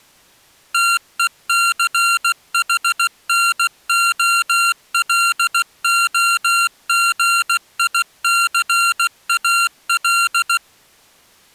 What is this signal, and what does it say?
Morse code, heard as electronic beeps, machine-sent, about 16 wpm, 1380 Hz. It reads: TECHNOLOGICAL